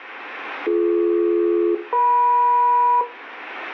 Aircraft SELCAL, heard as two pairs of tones, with room echo. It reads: BD-EM